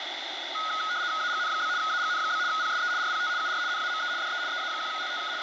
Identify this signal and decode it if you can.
RTTY (75 baud, 170 Hz shift), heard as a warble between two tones, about 1360 Hz centre, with radio static. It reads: AGN? AGN? PSE RPT UR NAME DE EA1LTK …